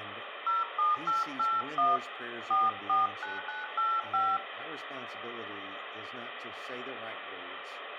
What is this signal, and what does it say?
DTMF, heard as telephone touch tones, dialled by hand, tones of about 170 ms, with phone line noise, room echo and speech in English. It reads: 07881 449985